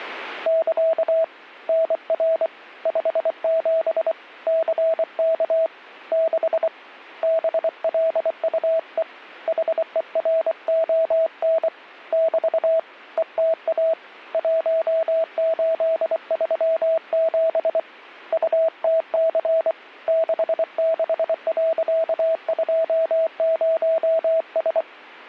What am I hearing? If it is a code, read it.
Morse code, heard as a keyed tone, hand-sent with a paddle, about 24 wpm, 650 Hz. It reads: <KA> NR 57 CK 6 BLUE HERON <BT> ETA 1837 UTC 66.20S